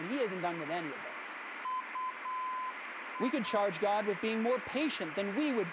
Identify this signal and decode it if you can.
Morse code, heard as a keyed tone, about 8 wpm, 1020 Hz, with heavy radio static and speech in English. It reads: UI